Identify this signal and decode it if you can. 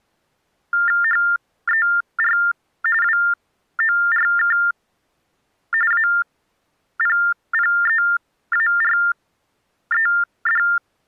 TTY/TDD text telephone tones (45.45 baud Baudot), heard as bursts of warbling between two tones, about 400 Hz shift, 1600 Hz centre. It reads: HER WORK APPEARED